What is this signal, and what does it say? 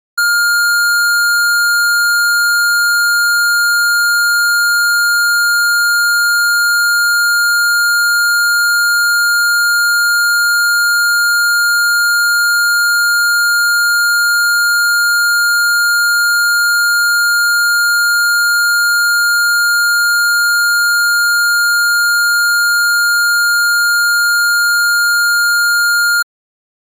A steady tone. There is no code.